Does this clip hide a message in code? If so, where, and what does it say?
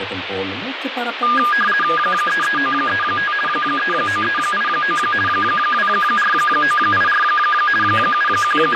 Yes: RTTY (50 baud, 450 Hz shift) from 1.2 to 8.8 s, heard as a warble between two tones, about 1430 Hz centre, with radio static and speech in Greek. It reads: 33935 39389 24984 …